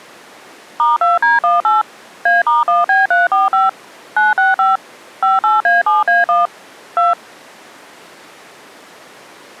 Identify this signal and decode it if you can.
DTMF, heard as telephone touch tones, dialled by machine, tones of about 170 ms. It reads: *2D18 A*1B345 965 58A7A1 2